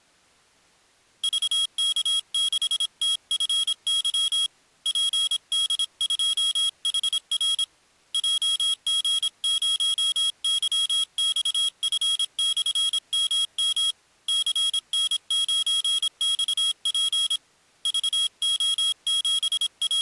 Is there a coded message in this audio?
Yes: Morse code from 1.2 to 20.0 s, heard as a high beeper, hand-sent with a paddle, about 26 wpm, 3300 Hz. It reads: VK6TFY PD2HR JG0YXF/MM CN9XP …